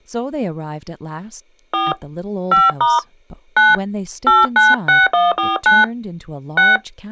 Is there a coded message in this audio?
Yes: DTMF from 1.7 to 6.8 s, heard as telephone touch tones, dialled by hand, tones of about 180 ms, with speech in English. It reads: 4 5* 9 896149 6